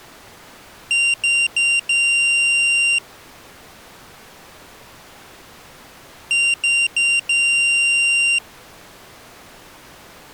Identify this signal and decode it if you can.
Beep code, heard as a piezo beeper, played twice, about 2750 Hz. 3 short, 1 long.